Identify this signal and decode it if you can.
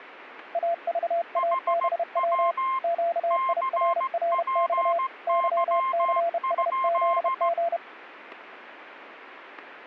Morse code, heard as two keyed tones. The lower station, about 31 wpm, 680 Hz: AVABW QIRRX YCSZG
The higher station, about 16 wpm, 1060 Hz: HW CPY?